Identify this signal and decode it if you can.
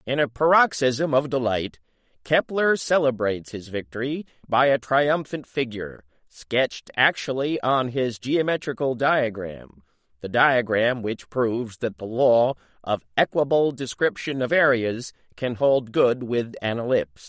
Speech in English. There is no code.